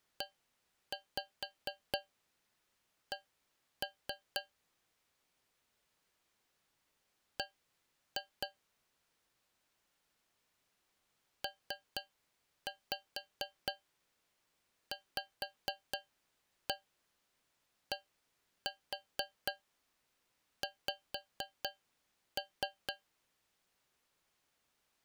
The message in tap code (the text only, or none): EC B PVDX